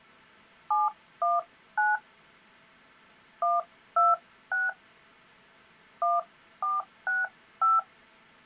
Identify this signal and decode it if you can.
DTMF, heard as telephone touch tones, dialled by hand, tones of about 180 ms. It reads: 719 126 1465